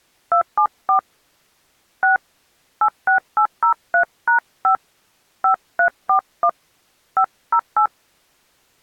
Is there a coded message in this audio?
Yes: DTMF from 0.3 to 7.9 s, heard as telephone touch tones, dialled by hand, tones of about 100 ms. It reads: 274 6 86803#5 5341 508